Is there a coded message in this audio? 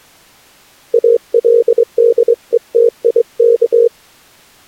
Yes: Morse code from 0.9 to 3.9 s, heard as a keyed tone, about 23 wpm, 470 Hz. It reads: ALDETIK